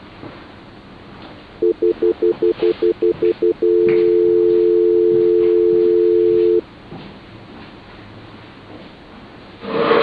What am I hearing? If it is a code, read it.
Telephone call progress tone (North American plan), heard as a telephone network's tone, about 350, 440 Hz, 0.1 s on and 0.1 s off. Stutter dial tone.